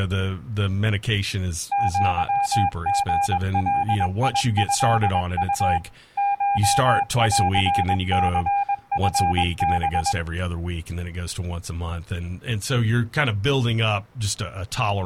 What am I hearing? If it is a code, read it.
Morse code (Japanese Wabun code), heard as a keyed tone, machine-sent, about 21 wpm, 800 Hz, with speech in English. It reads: アリガトウ コンニチハ